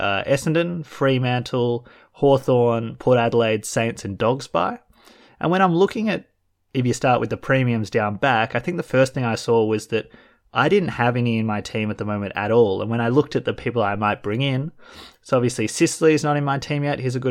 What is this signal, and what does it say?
Speech in English. There is no code.